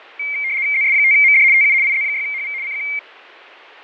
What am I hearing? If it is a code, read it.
RTTY (75 baud, 170 Hz shift), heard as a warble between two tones, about 2200 Hz centre, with fading. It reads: ZS5MD TU IZ6HV CQ